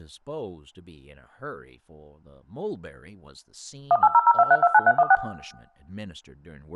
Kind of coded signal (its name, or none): DTMF